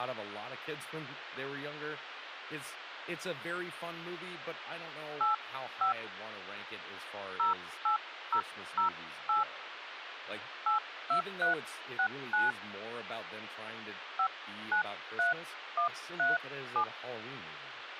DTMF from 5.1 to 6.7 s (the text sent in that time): 85